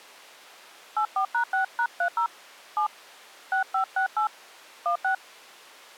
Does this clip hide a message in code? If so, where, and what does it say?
Yes: DTMF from 1.0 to 5.1 s, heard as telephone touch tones, dialled by hand, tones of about 90 ms. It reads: 84#6#30 7 6568 16